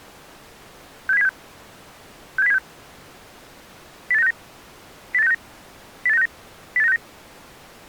Five-tone selective call (EEA), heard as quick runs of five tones, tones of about 40 ms. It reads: 67076 67076 08969 08969 08969 08969